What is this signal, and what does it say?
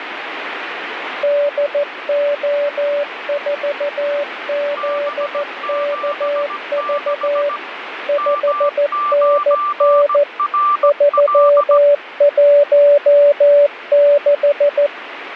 Morse code, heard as two keyed tones, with radio static. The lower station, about 14 wpm, 580 Hz: DO4ZKV 5NN 316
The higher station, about 17 wpm, 1180 Hz: B76 M9RL